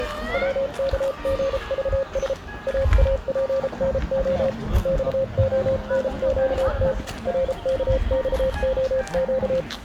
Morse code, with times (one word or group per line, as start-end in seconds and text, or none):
0.3-2.3 WKGVS
2.7-4.5 AAPNO
4.9-6.9 XONQT
7.3-9.6 RKXOQ